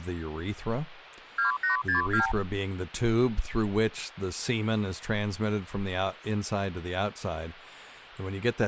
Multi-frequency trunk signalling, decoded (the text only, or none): 2862